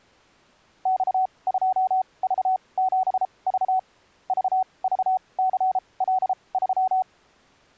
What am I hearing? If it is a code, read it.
Morse code, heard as a keyed tone, machine-sent, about 33 wpm, spaced as for 24 wpm, 750 Hz. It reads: X2V7V VVCL3